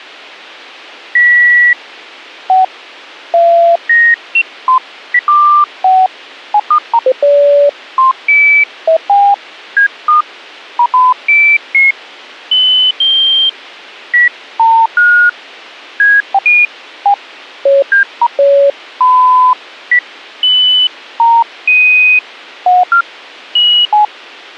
Electronic bleeps of random pitch and length. There is no code.